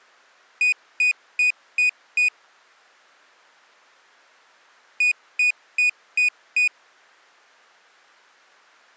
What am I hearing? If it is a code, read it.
Beep code, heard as a piezo beeper, played twice, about 2450 Hz. 5 short. In AMI BIOS tables: processor failure; in Dell tables: CMOS battery failure.